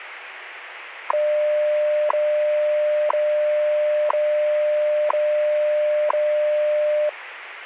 Radio time signal (WWV, Colorado), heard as ticks, one a second, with radio static.